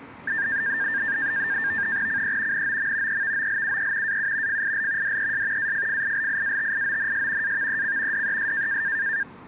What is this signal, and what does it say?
NAVTEX (SITOR-B), 100 baud, 170 Hz shift, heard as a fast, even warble, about 1700 Hz centre, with street noise. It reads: CE NOM EVOLUE AU FIL DES AFFILIATIONS AVEC DES